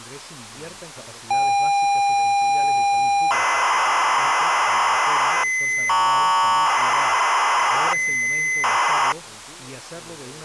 ZX Spectrum tape loading, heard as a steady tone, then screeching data.